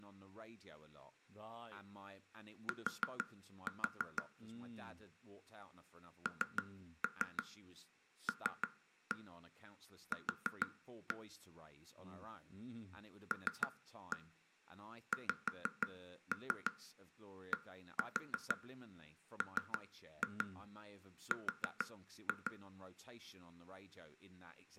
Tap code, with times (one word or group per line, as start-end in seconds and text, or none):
2.7-4.2 T
6.3-11.2 NLQ
13.3-22.5 LXDMR